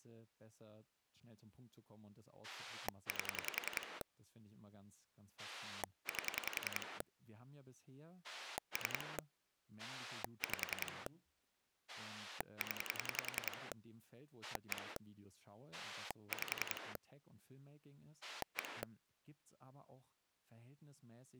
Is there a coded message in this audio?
Yes: pulse dialling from 2.4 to 18.8 s, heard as a rotary dial, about 10 pulses a second, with speech in German. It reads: 8 8 3 5 0 1 5 1